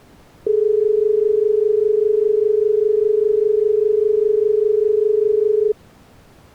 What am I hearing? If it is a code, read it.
Telephone call progress tone (as in Australia), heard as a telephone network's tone, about 430 Hz. Dial tone.